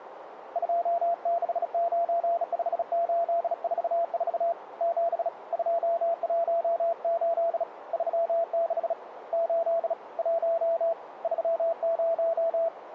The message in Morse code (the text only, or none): 2695844 7 218 36 8 1 30